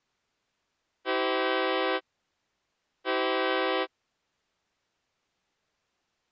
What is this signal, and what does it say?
Train horn signal, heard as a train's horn. 2 short. On North American railways: a signal is acknowledged.